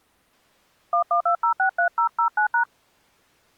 DTMF, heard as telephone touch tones, dialled by hand, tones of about 100 ms. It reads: 112063009#